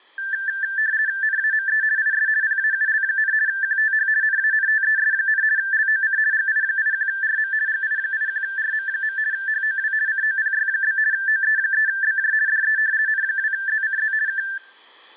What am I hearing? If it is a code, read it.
RTTY (50 baud, 170 Hz shift), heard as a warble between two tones, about 1650 Hz centre. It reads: NAME IS PAUL, QTH NANTES, LOC GI81RM GI81RM. HOW COPY? OE3BJ DE N2ZCZ K